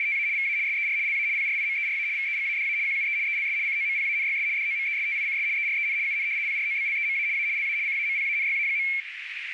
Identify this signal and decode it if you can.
RTTY (75 baud, 170 Hz shift), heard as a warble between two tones, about 2250 Hz centre, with radio static and a narrow filter. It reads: … VA SER LA PRIMERA VEGADA QUE ELS COMPANYS DOMESTICS EREN UN PROBLEMA A LA CAMPANYA.